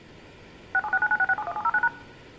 DTMF, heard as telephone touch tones, dialled by machine, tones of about 50 ms, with room echo. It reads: 676996671709#